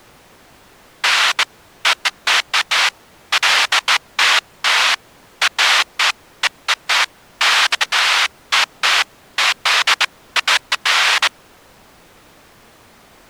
Bursts of noise. There is no code.